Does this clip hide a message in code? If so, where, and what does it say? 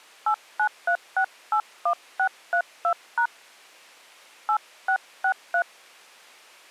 Yes: DTMF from 0.3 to 5.6 s, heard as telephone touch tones, dialled by hand, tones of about 80 ms. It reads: 893681632# 8663